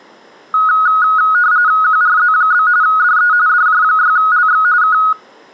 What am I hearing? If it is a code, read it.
RTTY (45.45 baud, 170 Hz shift), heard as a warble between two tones, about 1360 Hz centre. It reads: QRZ? DE DJ6LX K